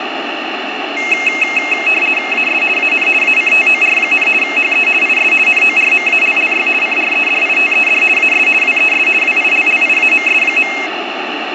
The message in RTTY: AS AN ACTOR, HE IS NORMALLY CREDITED AS WES WILLIAMS.

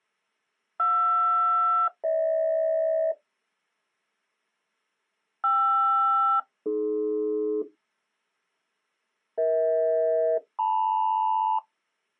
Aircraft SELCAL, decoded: JR-GH KR-AD EH-LM

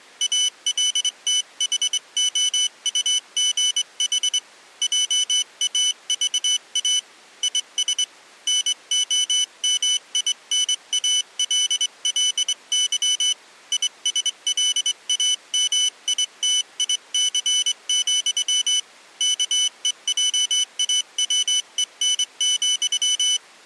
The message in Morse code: ALTHOUGH JAVA IS NOMINALLY ISLAMITIC, KEJAWEN,

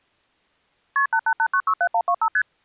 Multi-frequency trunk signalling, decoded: KP 888967125 ST

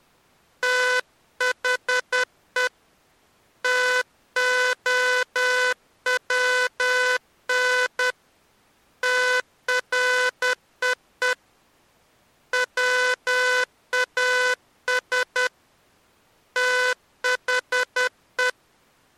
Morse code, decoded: THE TOWN TREE WAS THE

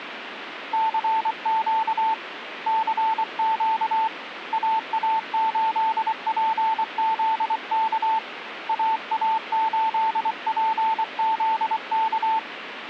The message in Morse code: CQ CQ AA8PZK AA8PZK

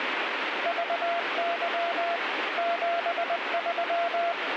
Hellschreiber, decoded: none

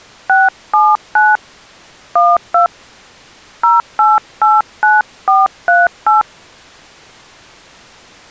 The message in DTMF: 679 12 0889438

